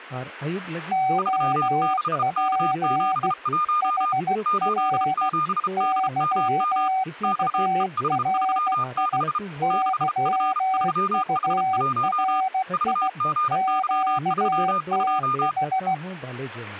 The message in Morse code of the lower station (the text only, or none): OP HR YURI YURI QTH